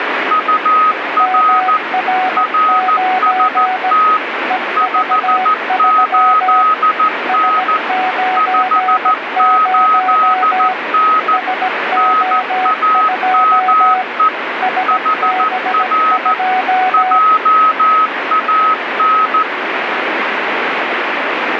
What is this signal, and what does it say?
Morse code, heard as two keyed tones, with radio static. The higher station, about 14 wpm, 1270 Hz: UR RST 58N 58N NAME HR JAN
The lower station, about 17 wpm, 740 Hz: MR9 EV3 S90 SO2 SB2